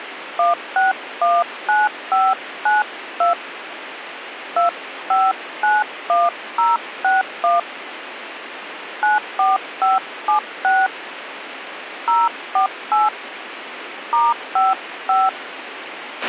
DTMF, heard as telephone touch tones, dialled by hand, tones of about 160 ms, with radio hiss and a squelch burst at the end. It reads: 1619592 2591061 94576 048 *55